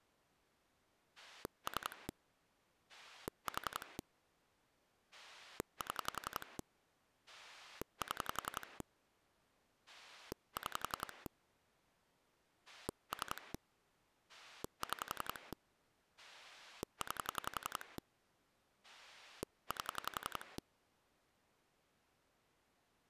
Pulse dialling, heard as a rotary dial, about 11 pulses a second. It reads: 3 4 7 7 6 3 6 9 8